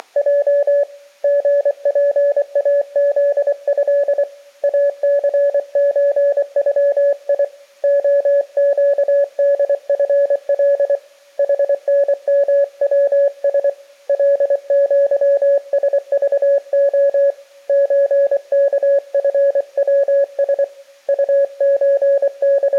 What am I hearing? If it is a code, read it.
Morse code (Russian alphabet), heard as a keyed tone, hand-sent with a paddle, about 24 wpm, 560 Hz. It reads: … ГПАЗЭ АЦЧЮИ ОЩДФЛ ХНМВС ЛЪСЖО ЧКФВС …